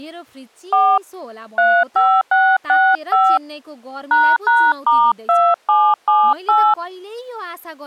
DTMF, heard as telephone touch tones, dialled by hand, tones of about 260 ms, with speech in Nepali. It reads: 4 35665 ##*2778